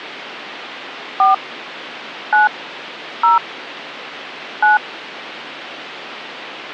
DTMF, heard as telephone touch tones, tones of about 150 ms. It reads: 4 9 0 9